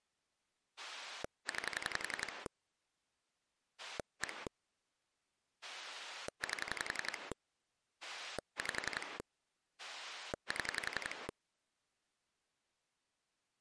Pulse dialling, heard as a rotary dial, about 11 pulses a second. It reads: 9 1 8 5 7